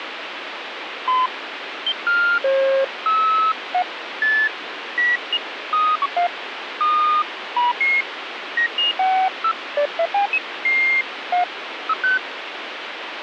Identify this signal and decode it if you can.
Electronic bleeps of random pitch and length, with radio static. There is no code.